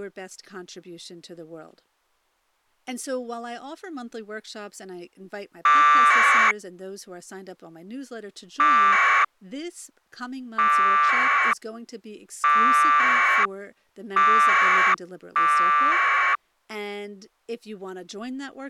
Packet radio (AX.25, as in APRS), 1200 baud, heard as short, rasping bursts, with speech in English.